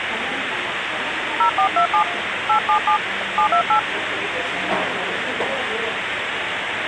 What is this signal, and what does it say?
DTMF, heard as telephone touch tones, dialled by hand, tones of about 90 ms, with phone line noise and the noise of a cafe. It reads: 0427 877 728